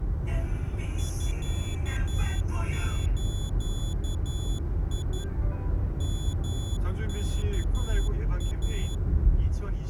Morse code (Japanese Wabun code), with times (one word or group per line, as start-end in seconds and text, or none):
1.0-5.2 ミズ
6.0-8.9 ヨワイ